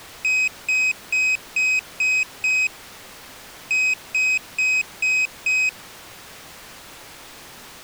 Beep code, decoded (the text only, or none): 6-5